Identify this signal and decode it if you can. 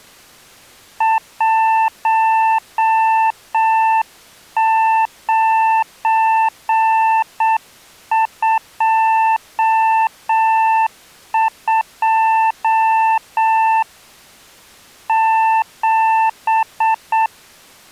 Morse code, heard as a keyed tone, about 7 wpm, 890 Hz. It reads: 1922 7